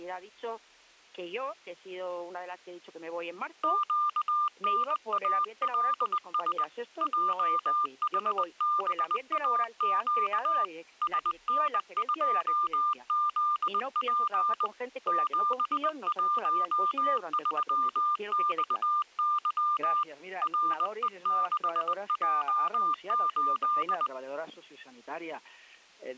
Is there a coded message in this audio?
Yes: Morse code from 3.6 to 24.1 s, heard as a keyed tone, hand-sent with a paddle, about 20 wpm, 1200 Hz. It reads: QNALS JHBAQ SN2ZP 713XY RE6J8